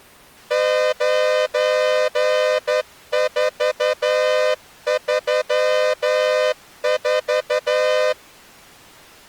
Morse code, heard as a horn, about 11 wpm. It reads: 9434